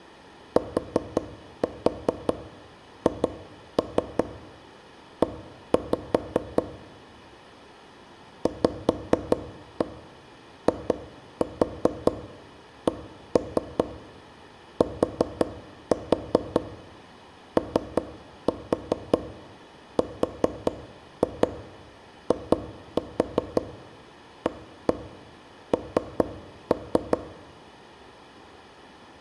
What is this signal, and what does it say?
Tap code, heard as knocks on wood, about 5 knocks a second, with room echo. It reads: THE VICTORIAN